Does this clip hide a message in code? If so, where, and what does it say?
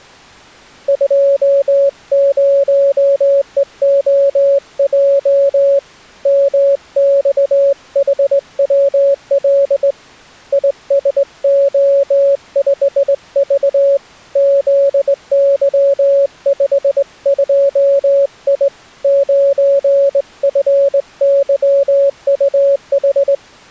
Yes: Morse code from 0.8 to 23.4 s, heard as a keyed tone, hand-sent with a straight key, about 20 wpm, 560 Hz. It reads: 20EOJ MXHWL ISO5V ZY52I 9FYUH